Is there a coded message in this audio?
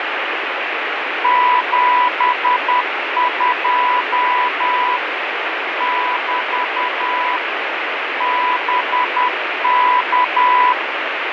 Yes: Morse code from 1.2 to 10.8 s, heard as a keyed tone, machine-sent, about 10 wpm, 990 Hz, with heavy radio static. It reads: 72 <BT> BK